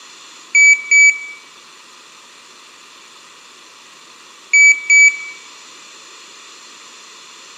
Beep code, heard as a piezo beeper, played twice, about 2300 Hz, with room echo. 2 short. In AMI BIOS tables: memory parity error; in IBM BIOS tables: self-test error shown on screen; in Dell tables: no memory detected.